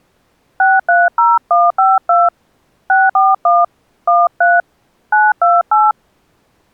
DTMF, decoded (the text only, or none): 630152 641 13 928